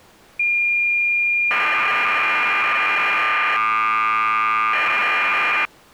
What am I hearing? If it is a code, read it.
Cassette data (Kansas City type), 1200 baud, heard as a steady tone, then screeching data.